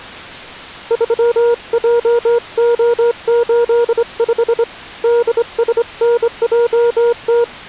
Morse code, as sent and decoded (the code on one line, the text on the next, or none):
...-- .--- --- ---.. ..... / -.. ... -. .--- -
3JO85 DSNJT